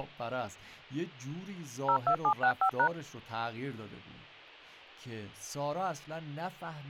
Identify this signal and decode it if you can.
DTMF, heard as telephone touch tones, dialled by machine, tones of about 80 ms, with speech in Persian. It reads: 02765#